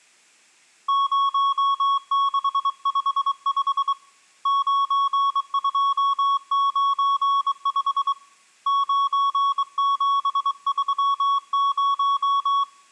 Morse code, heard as a keyed tone, hand-sent with a straight key, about 23 wpm, 1110 Hz, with room echo. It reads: 0655 9295 9730